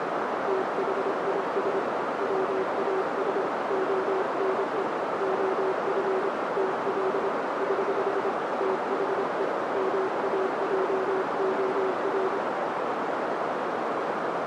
Morse code, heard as a keyed tone, hand-sent with a paddle, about 26 wpm, 380 Hz, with heavy radio static and a narrow filter. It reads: THIS WAS ONE OF TL <HH> THE MAJOR